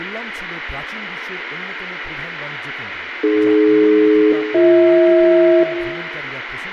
Aircraft SELCAL, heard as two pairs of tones, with room echo and speech in Bangla. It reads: AD-BH